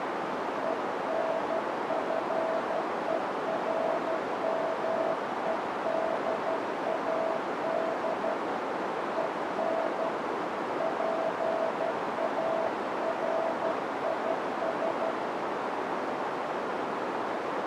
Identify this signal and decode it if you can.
Morse code, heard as a keyed tone, hand-sent with a paddle, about 12 wpm, 650 Hz, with heavy radio static and a narrow filter. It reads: ENFERMEDAD EN PARIS